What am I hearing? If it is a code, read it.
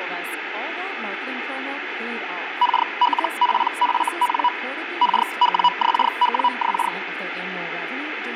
Hellschreiber (Feld-Hell, 122.5 baud), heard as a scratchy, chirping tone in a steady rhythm, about 980 Hz, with radio static and speech in English. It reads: KLPFN KWXWX